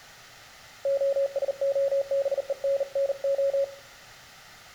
Morse code (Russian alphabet), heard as a keyed tone, hand-sent with a bug key, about 39 wpm, 550 Hz, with room echo. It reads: ОСОБЕННО